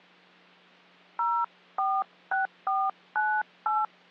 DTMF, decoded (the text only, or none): 046498